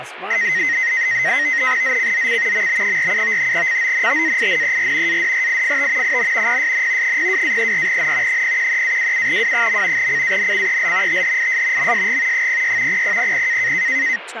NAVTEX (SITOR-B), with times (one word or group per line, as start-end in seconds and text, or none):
1.8-2.7 ZCZC
2.5-3.5 MB47
3.5-5.2 CONTAINER
5.1-6.2 ADRIFT
6.0-6.6 IN
6.5-7.2 PSN
7.0-8.4 02-34N
8.3-10.1 013-27W.
10.0-11.2 CANCEL
11.1-11.9 THIS
11.8-12.5 MSG
12.3-13.0 06
12.9-13.7 0000